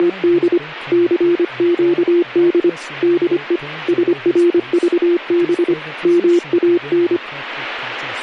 Morse code, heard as a keyed tone, hand-sent with a paddle, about 25 wpm, 350 Hz, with speech in English. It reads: … CQD DE SRVB MAN